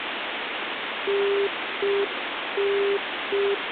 Telephone call progress tone (UK plan), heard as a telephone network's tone, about 400 Hz, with phone line noise. Congestion tone.